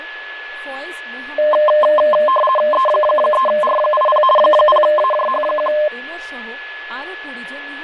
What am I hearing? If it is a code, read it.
RTTY (50 baud, 450 Hz shift), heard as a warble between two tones, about 830 Hz centre, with fading, a steady whistle near 1710 Hz and speech in Bangla. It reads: E3R80 0AJH1